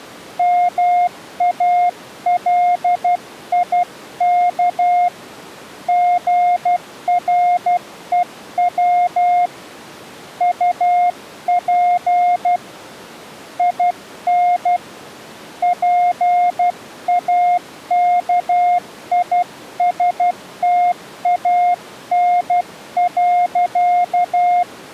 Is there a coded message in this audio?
Yes: Morse code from 0.3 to 24.7 s, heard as a keyed tone, hand-sent with a paddle, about 12 wpm, 710 Hz. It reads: MALIK GREW UP IN PAKISTAN.